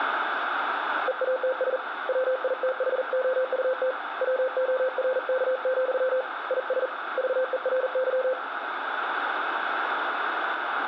Morse code, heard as a keyed tone, hand-sent with a paddle, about 40 wpm, 520 Hz, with radio static. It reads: EATS WITHOUT WORK, IS VERY